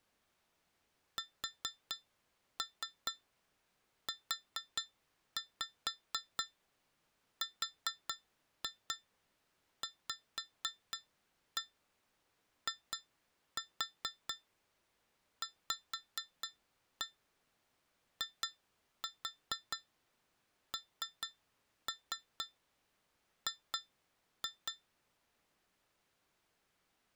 Tap code, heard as taps on glass, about 4 knocks a second. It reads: SURVIVING